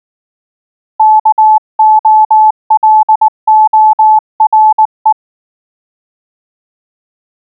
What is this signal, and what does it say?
Morse code, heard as a keyed tone, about 19 wpm, 860 Hz. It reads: KOLORE